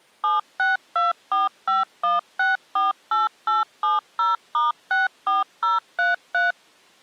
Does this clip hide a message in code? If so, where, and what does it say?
Yes: DTMF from 0.2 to 6.5 s, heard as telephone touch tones, dialled by machine, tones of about 160 ms. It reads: 762451648870*64033